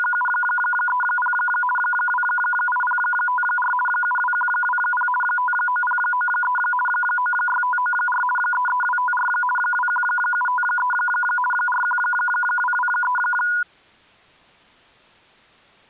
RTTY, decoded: … 28054 72120 59093 96594 33254 21753 41223

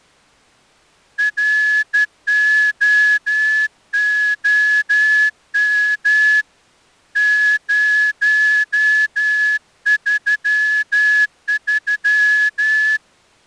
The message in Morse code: ROOM 033

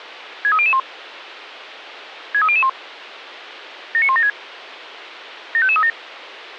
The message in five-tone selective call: 63001 63001 79176 75537

